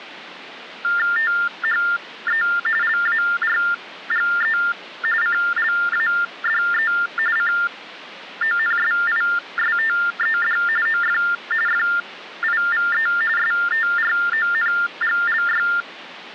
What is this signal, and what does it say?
TTY/TDD text telephone tones (45.45 baud Baudot), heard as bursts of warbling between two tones, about 400 Hz shift, 1600 Hz centre. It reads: THE LARGE CLADE CONSISTED OF FIVE STRONGLY